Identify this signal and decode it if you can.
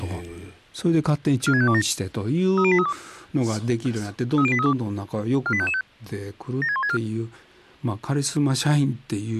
Five-tone selective call (ZVEI), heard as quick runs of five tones, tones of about 70 ms, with speech in Japanese. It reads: 46527 30832 30832 48555 76164